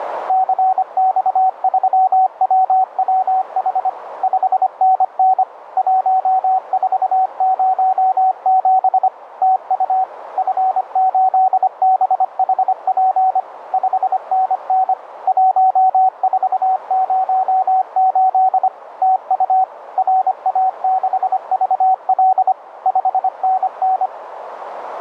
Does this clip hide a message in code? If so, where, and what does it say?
Yes: Morse code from 0.2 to 24.1 s, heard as a keyed tone, machine-sent, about 25 wpm, 760 Hz, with radio static and a narrow filter. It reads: CX3WWH 5NN 1407 TU F8BHP 5NN 1408 TU RA6VL 5NN